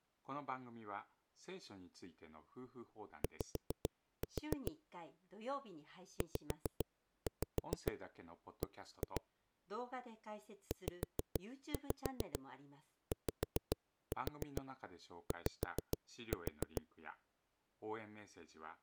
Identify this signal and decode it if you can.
Tap code, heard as knocks on a wall, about 7 knocks a second, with speech in Japanese. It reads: Y ZB ZYY